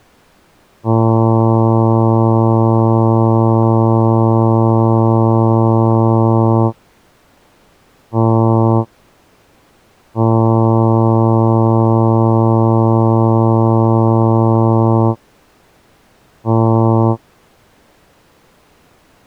Ship horn signal, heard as a ship's horn, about 110 Hz. 1 long, 1 short, 1 long, 1 short. At sea: I agree to be overtaken.